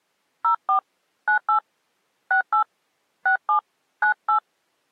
DTMF, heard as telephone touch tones, dialled by hand, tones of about 100 ms. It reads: 04 98 68 67 98